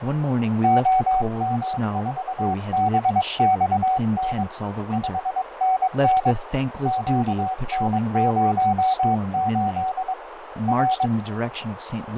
Morse code, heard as a keyed tone, hand-sent with a paddle, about 22 wpm, 750 Hz, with radio static, fading, a narrow filter and speech in English. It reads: OM4BXN 5NN QN08 R